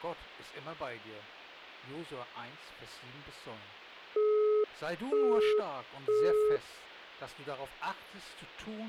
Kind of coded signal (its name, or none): telephone call progress tone